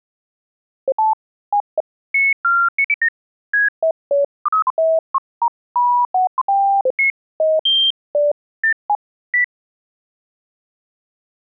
Electronic bleeps of random pitch and length. There is no code.